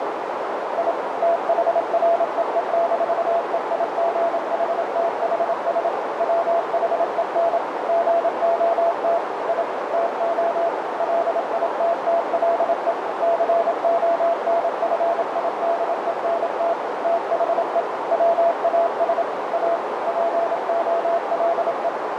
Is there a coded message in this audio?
Yes: Morse code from 0.7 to 21.9 s, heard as a keyed tone, machine-sent, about 27 wpm, 680 Hz, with heavy radio static and a narrow filter. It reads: I THREE-EIGHTHS WHEN GOT I TO LITTLE CONFIDENT THE WAS A POLE